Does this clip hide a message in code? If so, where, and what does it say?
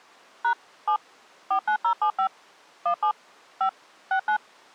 Yes: DTMF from 0.4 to 4.4 s, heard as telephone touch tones, dialled by machine, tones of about 90 ms. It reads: # 7 49075 17 5 69